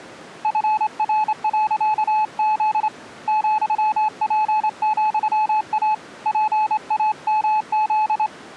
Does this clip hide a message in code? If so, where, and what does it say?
Yes: Morse code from 0.4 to 8.3 s, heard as a keyed tone, hand-sent with a straight key, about 26 wpm, 860 Hz. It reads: FR.Z ,P,A PAMZ